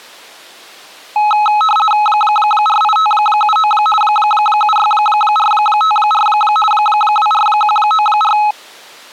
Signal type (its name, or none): RTTY